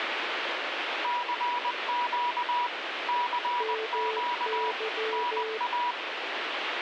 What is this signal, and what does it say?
Morse code, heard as two keyed tones, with radio static. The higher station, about 20 wpm, 970 Hz: CQ CQ NA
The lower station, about 14 wpm, 440 Hz: MY